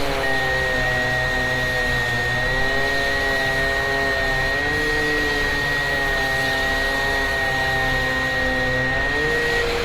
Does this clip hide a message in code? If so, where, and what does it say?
Yes: FT8 (one signal) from 0.2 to 9.6 s, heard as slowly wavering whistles, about 6.25 baud, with radio static, a steady whistle near 500 Hz and street noise.